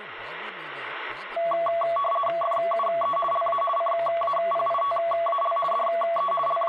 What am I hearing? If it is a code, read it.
RTTY (50 baud, 450 Hz shift), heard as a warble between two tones, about 900 Hz centre, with radio static and speech in Telugu. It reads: FUE LA CAPITAL DE …